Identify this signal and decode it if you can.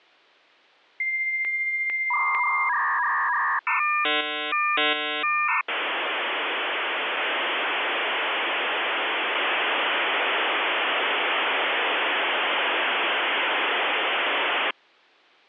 Dial-up modem handshake (V.34 or later), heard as a whistle, warbles, then hiss.